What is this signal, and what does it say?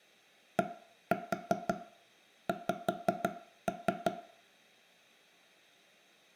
Tap code, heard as knocks on wood, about 5 knocks a second, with room echo. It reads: DX